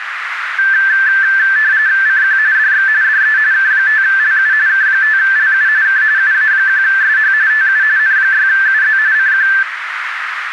RTTY (45.45 baud, 170 Hz shift), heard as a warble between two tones, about 1650 Hz centre, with radio static and a narrow filter. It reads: CQ DX DE K5LU K5LU K UA1SH TU N6UZ CQ